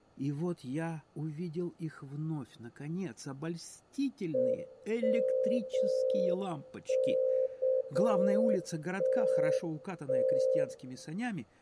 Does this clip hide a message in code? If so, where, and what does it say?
Yes: Morse code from 4.3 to 10.7 s, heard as a keyed tone, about 7 wpm, 520 Hz, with room echo. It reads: EMKTT